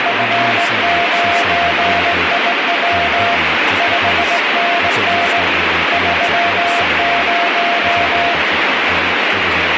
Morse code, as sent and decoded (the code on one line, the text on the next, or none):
..-. ----. .. .-- / ..... -. -. / ...-- -----
F9IW 5NN 30